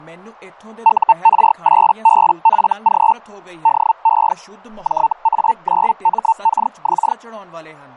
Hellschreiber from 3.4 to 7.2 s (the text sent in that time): DE JA9MKX